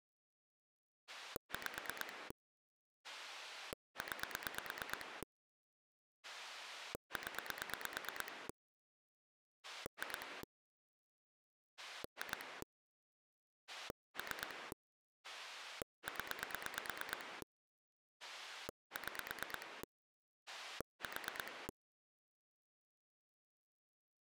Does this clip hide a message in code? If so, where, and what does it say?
Yes: pulse dialling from 1.1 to 21.7 s, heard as a rotary dial, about 9 pulses a second. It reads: 5 9 0 2 2 3 0 6 4